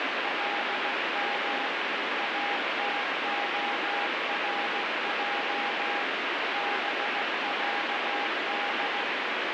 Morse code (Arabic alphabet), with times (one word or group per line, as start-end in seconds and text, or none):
0.2-1.7 لم
2.2-6.0 اتخرج
6.5-9.0 بعد